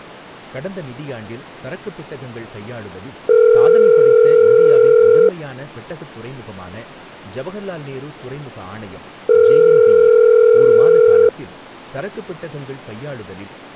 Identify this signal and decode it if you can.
Telephone call progress tone (North American plan), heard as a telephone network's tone, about 440, 480 Hz, 2 s on and 4 s off, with speech in Tamil. Ringback tone.